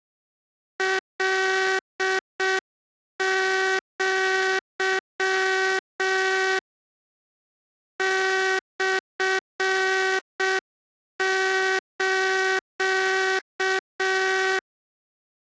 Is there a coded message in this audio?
Yes: Morse code (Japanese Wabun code) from 0.7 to 14.6 s, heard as a buzzer, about 6 wpm. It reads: カア モス